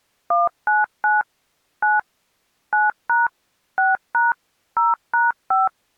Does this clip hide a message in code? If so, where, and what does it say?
Yes: DTMF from 0.3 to 5.7 s, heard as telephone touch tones, dialled by machine, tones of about 170 ms. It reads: 199 9 9# 6# 0#5